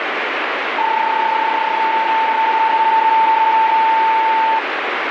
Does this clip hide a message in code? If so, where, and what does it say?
Yes: PSK31 (31.25 baud) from 0.8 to 4.6 s, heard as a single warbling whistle, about 890 Hz, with radio static.